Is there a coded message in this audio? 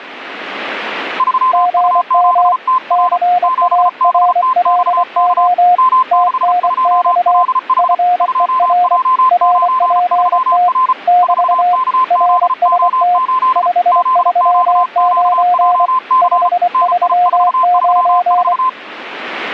Yes: Morse code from 1.1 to 18.8 s, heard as two keyed tones. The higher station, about 34 wpm, 1030 Hz: 3U7TR 7BTXK M62LH 2J93R 4KZO8 ZQQJC NI434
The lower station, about 24 wpm, 720 Hz: GM CARLO TNX FER RPT <BT> RST 539 539